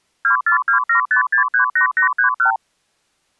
Multi-frequency trunk signalling (R2, with the far end's replies), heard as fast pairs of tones, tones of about 110 ms. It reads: 24275638831